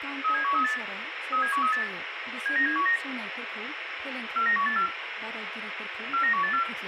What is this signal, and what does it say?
Five-tone selective call (CCIR), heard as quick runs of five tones, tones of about 100 ms, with radio hiss, room echo and speech in Bodo. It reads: 37138 37138 79719 49184 49184